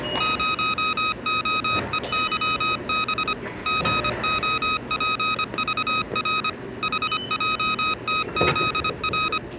Morse code, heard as electronic beeps, machine-sent, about 25 wpm, 1260 Hz, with the noise of a subway station. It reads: 0OEYB GOPVR HJTZR